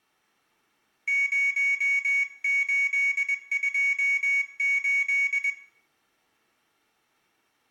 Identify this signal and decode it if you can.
Morse code, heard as a high beeper, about 21 wpm, 2250 Hz, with room echo. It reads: 0828